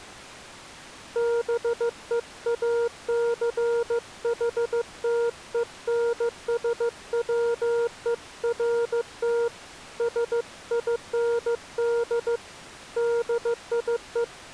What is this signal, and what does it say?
Morse code, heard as a keyed tone, hand-sent with a paddle, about 15 wpm, 470 Hz. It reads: BEACHTENSWERT SIND DIE